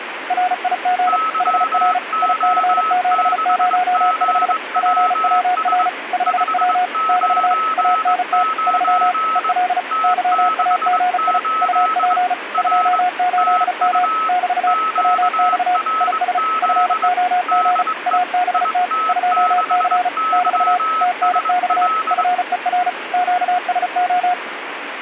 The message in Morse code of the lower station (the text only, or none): RIG HR IC705 PWR 5W <BT> ANT 3 EL YAGI UP 28M <BT> WX IS FOG ABT 2C <BT> TNX FER QSO